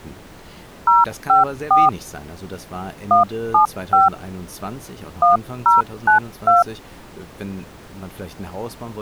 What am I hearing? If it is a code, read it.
DTMF, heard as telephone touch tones, dialled by hand, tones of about 150 ms, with speech in German. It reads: 054 175 1092